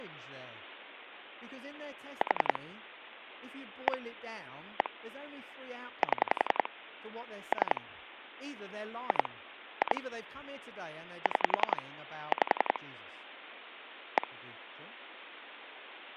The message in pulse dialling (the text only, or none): 4 1 1 7 3 2 2 6 5 1